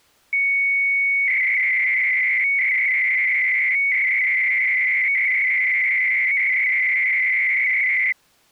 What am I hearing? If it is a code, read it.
300-baud modem data (Bell 103 tones), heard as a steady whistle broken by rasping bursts, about 300 baud, 200 Hz shift.